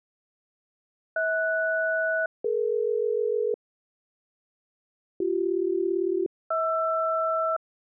Aircraft SELCAL, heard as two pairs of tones. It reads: HS-DE BC-HR